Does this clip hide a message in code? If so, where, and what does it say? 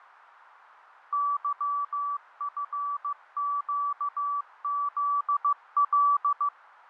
Yes: Morse code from 1.1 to 6.5 s, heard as a keyed tone, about 15 wpm, 1150 Hz, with radio static and fading. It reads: YFQZL